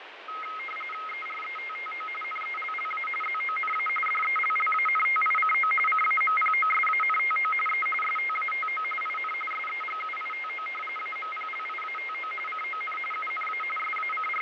RTTY (45.45 baud, 850 Hz shift), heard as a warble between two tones, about 1700 Hz centre, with radio static and fading. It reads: ERETTO NELLA ZONA DELLANTICO CAMPOSANTO E STATO IN SEGUITO AMPLIATO CON UNA …